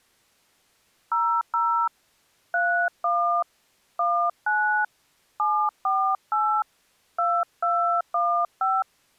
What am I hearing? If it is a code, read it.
DTMF, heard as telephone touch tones, dialled by hand, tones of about 300 ms. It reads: 00 31 19 748 2215